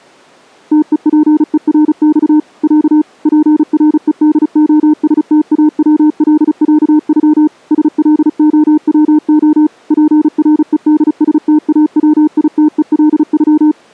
Morse code (Russian alphabet), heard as a keyed tone, machine-sent, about 35 wpm, 300 Hz. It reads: ТЕПЕРЬ Я ПРЕДОСТАВЛЯЮ СЛОВО ПРЕДСТАВИТЕЛЮ